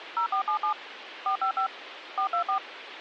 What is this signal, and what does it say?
DTMF, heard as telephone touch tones, dialled by machine, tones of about 100 ms, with phone line noise. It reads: 0477 455 424